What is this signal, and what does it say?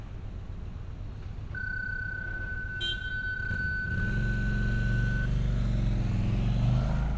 PSK31 (31.25 baud), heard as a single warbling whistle, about 1500 Hz, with fading and street noise.